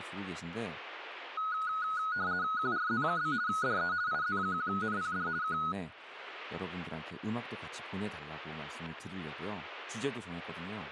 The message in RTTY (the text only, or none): QRZ? DE IZ1NPD K